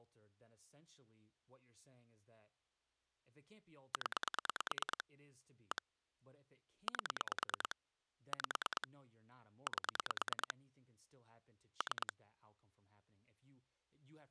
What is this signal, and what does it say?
Pulse dialling, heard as clicks on a phone line, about 9 pulses a second, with speech in English. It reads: 0 1 8 5 8 3